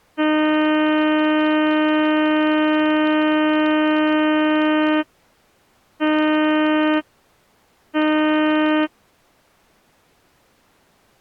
Ship horn signal, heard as a ship's horn, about 310 Hz. 1 long, 2 short. At sea: a vessel in fog that is sailing, fishing, towing or hampered.